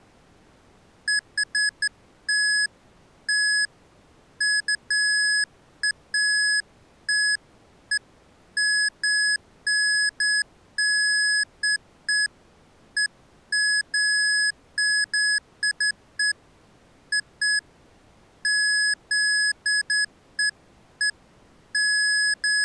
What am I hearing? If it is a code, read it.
Beeps of irregular length. There is no code.